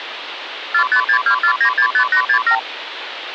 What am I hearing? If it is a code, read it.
Multi-frequency trunk signalling (R2, with the far end's replies), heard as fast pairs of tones, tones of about 90 ms, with phone line noise. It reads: 45624965867